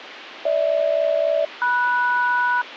Aircraft SELCAL, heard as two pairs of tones, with radio hiss. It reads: GH-MS